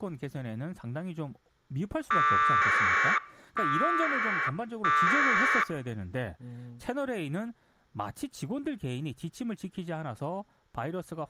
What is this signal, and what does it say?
Packet radio (AX.25, as in APRS), 1200 baud, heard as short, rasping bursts, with speech in Korean.